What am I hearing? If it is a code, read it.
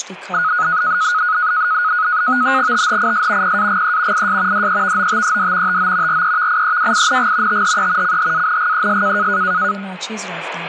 NAVTEX (SITOR-B), 100 baud, 170 Hz shift, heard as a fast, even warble, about 1360 Hz centre, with speech in Persian. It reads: THIS PAGE IS DEVOTED TO REVIEWING THE CHANGES